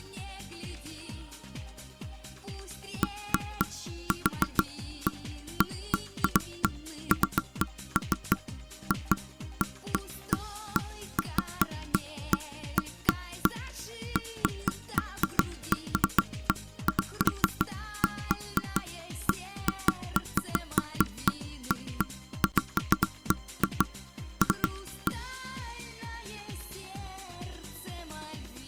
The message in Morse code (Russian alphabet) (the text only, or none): none